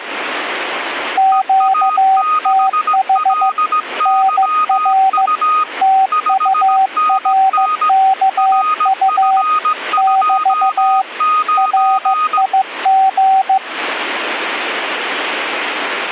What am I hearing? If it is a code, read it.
Morse code, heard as two keyed tones. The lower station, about 15 wpm, 770 Hz: QTH NR TURKU <BT> RIG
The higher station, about 17 wpm, 1240 Hz: EA6LYU 5NN RF29